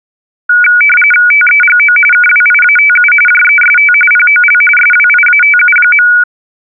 RTTY (45.45 baud, 850 Hz shift), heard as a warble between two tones, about 1900 Hz centre. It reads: TEGO KWIATU JEST POL SWIATU.